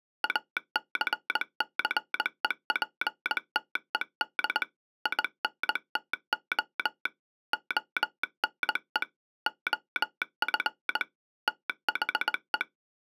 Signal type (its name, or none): Morse code